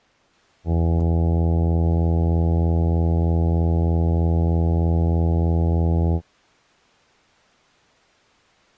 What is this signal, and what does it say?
Ship horn signal, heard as a ship's horn, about 80 Hz. 1 long. At sea: a vessel nearing a blind bend, or under power and making way in fog.